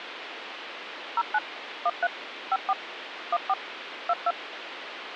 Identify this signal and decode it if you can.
DTMF, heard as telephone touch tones, dialled by machine, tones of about 40 ms, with phone line noise. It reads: 09 13 54 14 22